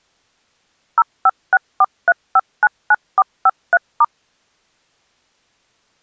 DTMF, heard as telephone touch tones, dialled by machine, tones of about 40 ms. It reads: 05643599453*